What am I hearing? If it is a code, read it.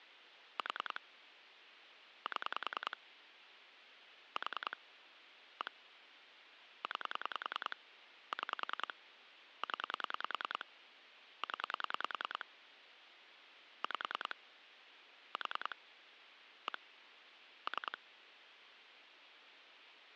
Pulse dialling, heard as clicks on a phone line, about 10 pulses a second, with phone line noise. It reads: 4 7 4 1 9 6 0 0 5 4 1 3